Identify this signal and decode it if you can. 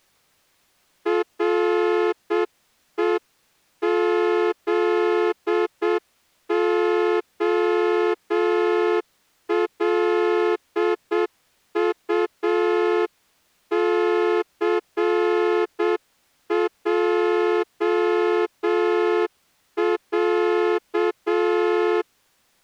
Morse code (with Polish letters), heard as a horn, hand-sent with a straight key, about 7 wpm. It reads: REZOLUCJĄ